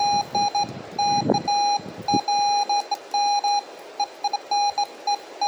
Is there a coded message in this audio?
No, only beeps of irregular length, with the noise of a residential street.